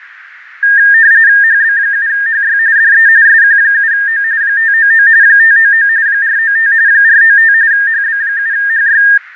RTTY (45.45 baud, 170 Hz shift), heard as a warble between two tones, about 1700 Hz centre, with radio static, fading and a narrow filter. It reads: HB7HY DE SQ7O 599 599 495 495 HB7HY